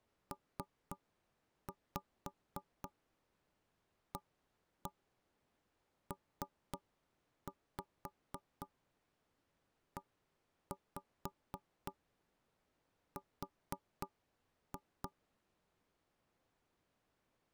Tap code, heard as knocks on wood, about 3 knocks a second. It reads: PAPER